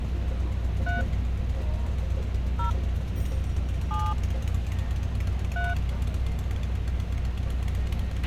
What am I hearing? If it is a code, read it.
DTMF, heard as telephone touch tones, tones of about 170 ms, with a squelch burst at the end and street noise. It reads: 3 0 7 3